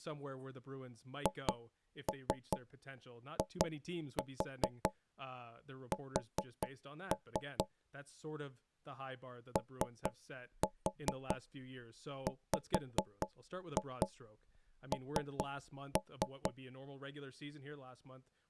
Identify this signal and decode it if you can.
Tap code, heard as knocks on wood, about 4 knocks a second, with speech in English. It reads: HIS OWN